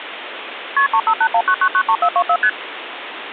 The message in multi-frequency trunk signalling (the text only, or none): KP 35819993424 ST